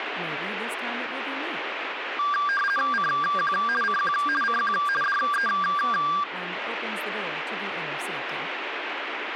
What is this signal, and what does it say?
RTTY (50 baud, 450 Hz shift), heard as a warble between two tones, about 1380 Hz centre, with radio static. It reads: CQ CQ CQ DE